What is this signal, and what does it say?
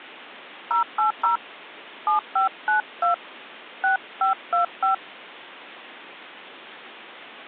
DTMF, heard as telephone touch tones, dialled by hand, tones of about 120 ms. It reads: 080 7592 6525